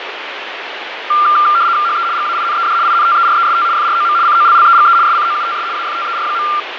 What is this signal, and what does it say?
RTTY (75 baud, 170 Hz shift), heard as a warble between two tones, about 1280 Hz centre, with radio static and fading. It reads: HE GAINED INTEREST FROM COLLEGE SCOUTS AFTER.